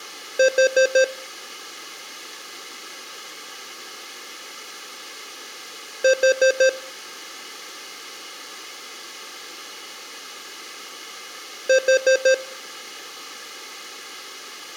Alarm pattern, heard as an alarm's beeps, played three times, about 520 Hz. Temporal four. Carbon monoxide.